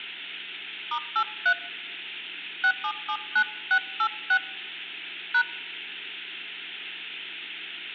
DTMF, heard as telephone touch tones, dialled by hand, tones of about 70 ms, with hum. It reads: *83 6779686 #